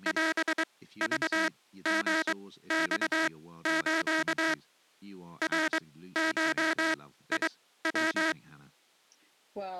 Morse code (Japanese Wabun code), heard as a buzzer, machine-sent, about 23 wpm, spaced as for 15 wpm, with speech in English. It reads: オクリマス ナゴヤ